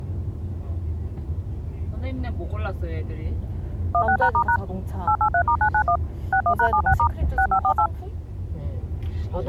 DTMF, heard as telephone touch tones, dialled by machine, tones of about 80 ms, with the noise inside a car. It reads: 16#*# 883*991 61#76* 6548